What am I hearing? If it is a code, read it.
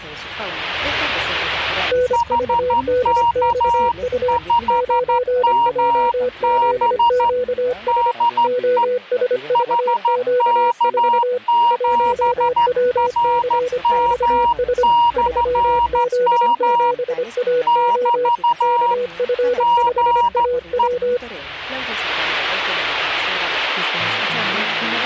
Morse code, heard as two keyed tones. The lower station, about 25 wpm, 500 Hz: NVDXU 9JZQS OSVQ4 1WCXS 3Z7AO KF5AW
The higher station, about 13 wpm, 950 Hz: HK5MB DE HK7RM/M <BT> GE